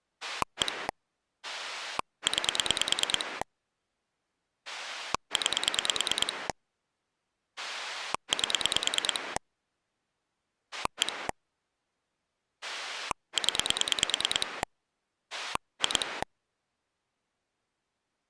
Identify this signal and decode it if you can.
Pulse dialling, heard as a rotary dial, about 9 pulses a second. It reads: 1 9 9 8 1 0 2